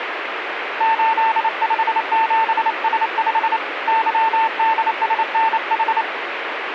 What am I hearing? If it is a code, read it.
Morse code, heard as a keyed tone, hand-sent with a paddle, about 28 wpm, 900 Hz, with radio static. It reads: 857S5 YDSNH